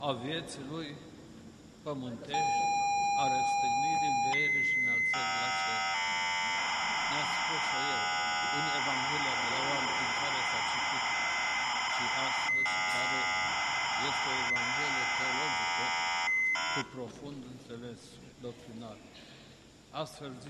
ZX Spectrum tape loading, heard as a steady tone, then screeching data.